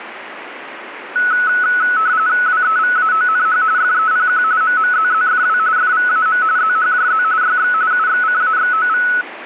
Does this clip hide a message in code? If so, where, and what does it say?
Yes: RTTY (45.45 baud, 170 Hz shift) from 1.2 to 9.2 s, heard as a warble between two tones, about 1390 Hz centre, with radio static. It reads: WEVAONH FEPQ MMZZFW FVAM ZHJZ YX UXCAXOV